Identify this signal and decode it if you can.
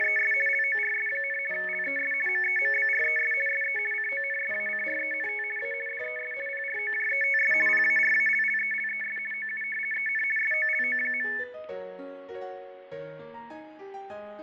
RTTY (50 baud, 450 Hz shift), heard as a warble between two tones, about 2000 Hz centre, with fading, static crashes and room echo. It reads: … LORS, LES MEMBRES SE CONSACRENT A DES PROJETS PARALLELES OU EN SOLO.